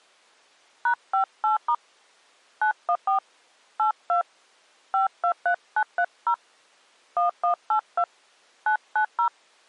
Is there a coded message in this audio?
Yes: DTMF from 0.9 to 9.3 s, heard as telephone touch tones, dialled by hand, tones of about 100 ms. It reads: #58* 914 82 523930 1182 990